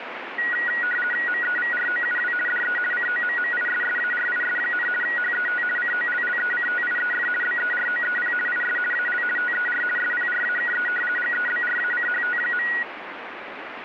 RTTY (50 baud, 450 Hz shift), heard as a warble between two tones, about 1700 Hz centre, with radio static. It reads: MEVROUW DE COMMISSARIS, HET COLLECTIEF BEROEP IS AL TER SPRAKE GEBRACHT.